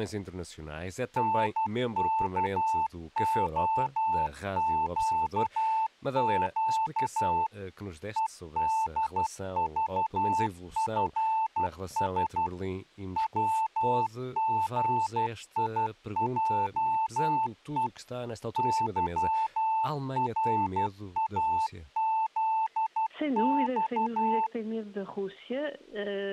Morse code, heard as a keyed tone, machine-sent, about 12 wpm, 880 Hz, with speech in Portuguese. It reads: NKOQQ EDVFS WGIJE YRAZX